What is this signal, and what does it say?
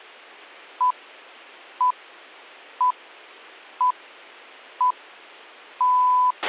Radio time signal (six pips, as the Greenwich Time Signal), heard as pips, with a squelch burst at the end.